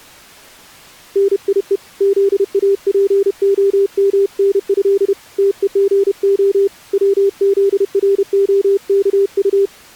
Morse code (with Polish letters), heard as a keyed tone, hand-sent with a paddle, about 31 wpm, 400 Hz. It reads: NIE ZAPOMNĘ TEGO WZROKU